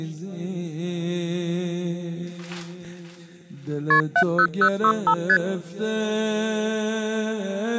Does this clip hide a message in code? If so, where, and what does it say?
Yes: multi-frequency trunk signalling (R1, as on North American trunks) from 3.9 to 5.4 s, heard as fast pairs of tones, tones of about 70 ms. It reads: KP 70065 ST